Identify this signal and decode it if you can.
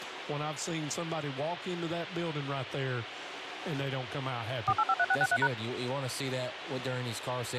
DTMF, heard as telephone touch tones, dialled by machine, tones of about 50 ms, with phone line noise. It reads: 4853663#